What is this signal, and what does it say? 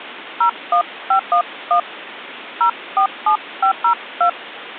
DTMF, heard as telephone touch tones, dialled by hand, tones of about 90 ms, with phone line noise. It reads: 01511 047502